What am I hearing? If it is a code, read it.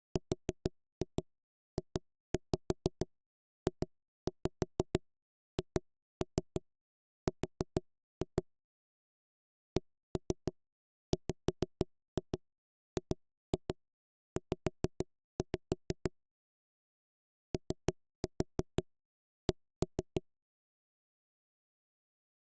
Tap code, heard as knocks on wood, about 6 knocks a second. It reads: RJJHR CWGZ OC